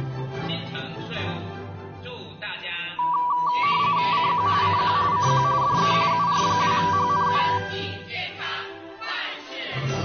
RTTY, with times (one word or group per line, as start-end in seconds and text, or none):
4.1-4.5 CQ
4.6-5.0 CQ
5.1-5.4 CQ
5.6-5.9 DE
6.1-7.4 UR2HNU